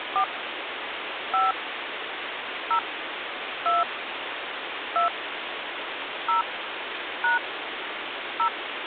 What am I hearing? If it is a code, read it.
DTMF, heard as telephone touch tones, dialled by hand, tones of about 130 ms, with phone line noise. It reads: 4 5 0 2 2 0 # 0